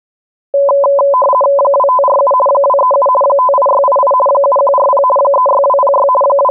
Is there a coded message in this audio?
Yes: RTTY (50 baud, 450 Hz shift) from 0.5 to 6.5 s, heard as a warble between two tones, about 780 Hz centre. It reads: 2547 237 58688 7140 36206 …